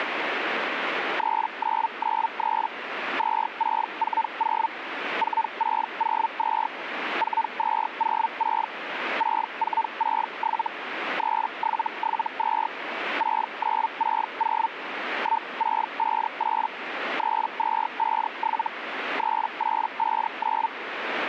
Hellschreiber (Feld-Hell, 122.5 baud), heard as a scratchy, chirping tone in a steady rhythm, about 900 Hz, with radio static. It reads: 3993 2640 4602 4206 6467 3772 6960 1658 3257 3859